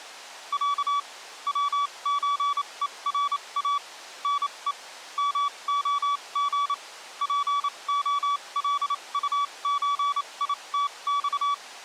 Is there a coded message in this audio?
Yes: Morse code (Russian alphabet) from 0.5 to 11.6 s, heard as a keyed tone, machine-sent, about 28 wpm, spaced as for 23 wpm, 1140 Hz. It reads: Я ВЧЕРА НЕ МОГ ПОЛУЧИТЬ